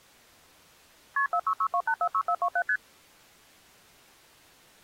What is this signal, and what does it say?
Multi-frequency trunk signalling (R1, as on North American trunks), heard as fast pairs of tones, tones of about 70 ms. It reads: KP 4662846427 ST